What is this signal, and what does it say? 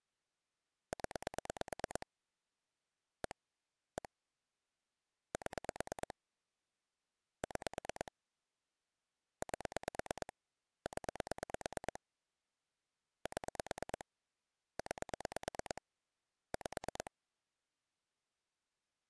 Pulse dialling, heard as clicks on a phone line, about 9 pulses a second. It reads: 0 1 1 7 6 8 0 7 9 5